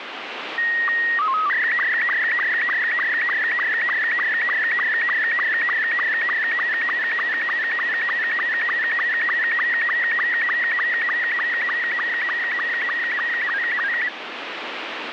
SSTV (slow-scan television), Robot 72, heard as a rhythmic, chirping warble, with radio static.